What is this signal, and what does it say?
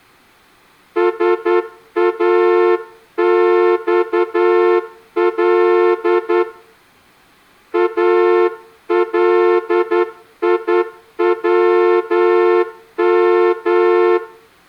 Morse code (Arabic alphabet), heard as a horn, hand-sent with a straight key, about 10 wpm, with room echo. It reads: ساصل اليوم